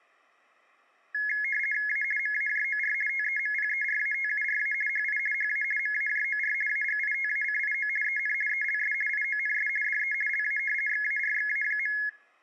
RTTY (50 baud, 450 Hz shift), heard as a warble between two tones, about 1900 Hz centre. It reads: A MAJOR TEMPERATURA HI HA MAJOR AGITACIO EN ELS IONS DE LA XARXA.